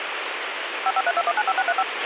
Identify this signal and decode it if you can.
DTMF, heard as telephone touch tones, dialled by machine, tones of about 50 ms, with radio hiss and a squelch burst at the end. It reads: 5532195635